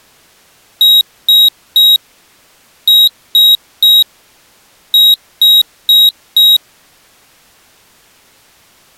Beep code, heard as a piezo beeper, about 3800 Hz. 3-3-4. In Phoenix BIOS tables: video failure.